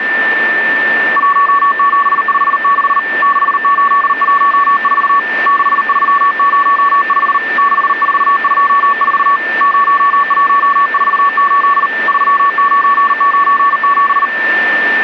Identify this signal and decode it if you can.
Morse code, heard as a keyed tone, hand-sent with a paddle, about 39 wpm, 1130 Hz, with radio static and a steady whistle near 1780 Hz. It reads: 1756 6814 6305 6424 0148 3997